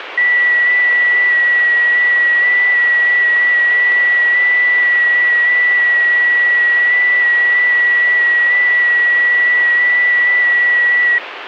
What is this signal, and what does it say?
FT8 (one signal), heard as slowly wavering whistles, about 6.25 baud, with radio static.